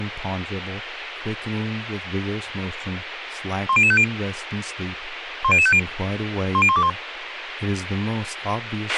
Five-tone selective call (ZVEI), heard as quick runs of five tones, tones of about 70 ms, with radio hiss, a squelch burst at the end and speech in English. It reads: 10050 10050 10121